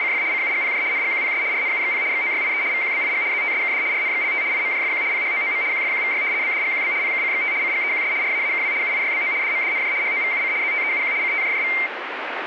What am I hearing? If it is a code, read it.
RTTY (75 baud, 170 Hz shift), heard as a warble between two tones, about 2200 Hz centre, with radio static. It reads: … CUGPJ NGQPS RNUXP XOYIE VQBIG ZTSKD RNXLT IMJFQ PHOOM QFQVY BDGQB PKCXT CGEQS RAAKW UIYBO DMDNJ HOVUC ZTEUQ CTJJV